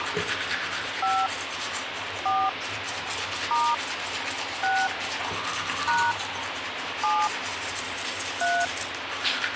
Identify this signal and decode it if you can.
DTMF, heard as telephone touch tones, dialled by hand, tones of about 240 ms, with radio hiss and the noise of a restroom. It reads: 5 4 * 6 # 7 3